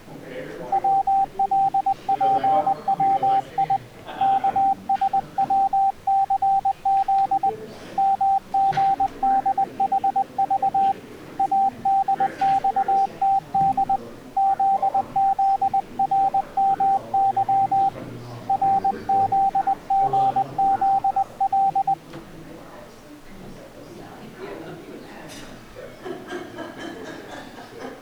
Morse code, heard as a keyed tone, hand-sent with a paddle, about 20 wpm, 780 Hz. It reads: WLPWI KSWCZ MGDHV ADXTD ZZRMY RZGZL